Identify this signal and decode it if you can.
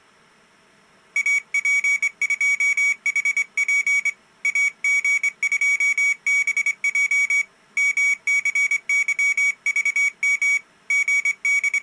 Morse code, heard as a high beeper, hand-sent with a straight key, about 24 wpm, 2250 Hz. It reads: AP2HP AG2BJ MCYVM …